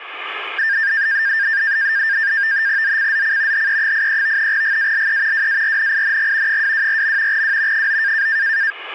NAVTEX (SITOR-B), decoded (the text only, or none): ZCZC HE83 GALE WARNING 224. W 9